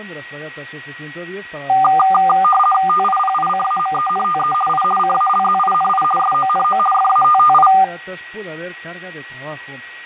RTTY (50 baud, 450 Hz shift), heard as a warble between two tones, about 990 Hz centre, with fading and a steady whistle near 1910 Hz. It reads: TIPICAMENTE I CALZINI SONO FATTI